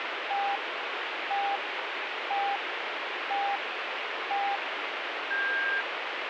Radio time signal (five pips and a higher one, as on Chinese radio), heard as pips, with radio static.